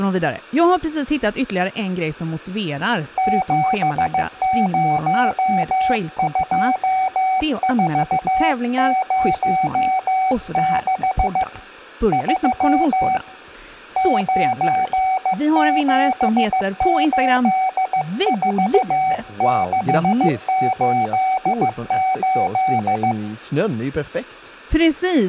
Morse code, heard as a keyed tone, hand-sent with a paddle, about 15 wpm, 760 Hz, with room echo and speech in Swedish. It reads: 702406 3 9784688